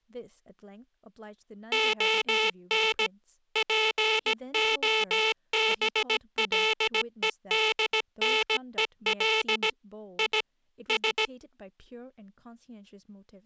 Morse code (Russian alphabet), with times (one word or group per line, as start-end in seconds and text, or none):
1.7-3.1 ОН
3.6-9.7 ПОБЛЕДНЕЛ
10.2-10.4 И
10.9-11.3 С